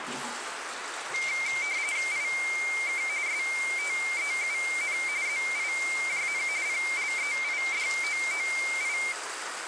RTTY (45.45 baud, 170 Hz shift), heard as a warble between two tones, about 2200 Hz centre, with radio static and the noise of a restroom. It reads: IK STEUN ZIJN PLEIDOOI